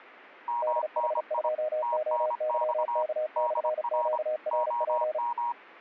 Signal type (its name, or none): Morse code